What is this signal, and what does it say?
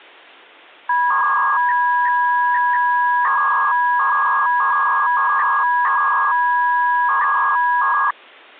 300-baud modem data (V.21 tones), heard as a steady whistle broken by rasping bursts, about 300 baud, 200 Hz shift.